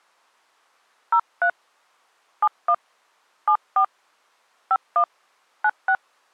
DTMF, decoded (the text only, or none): 03 71 74 51 96